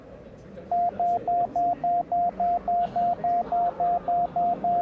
Evenly repeated beeps, with the noise of a crowd indoors. There is no code.